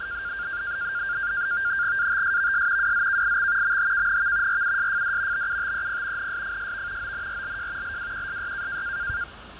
NAVTEX (SITOR-B), 100 baud, 170 Hz shift, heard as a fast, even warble, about 1500 Hz centre, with radio static, fading and street noise. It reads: ATSVS WZKIX MHKNV RUSFD BUTEP NSFSV ONRLJ LWQSY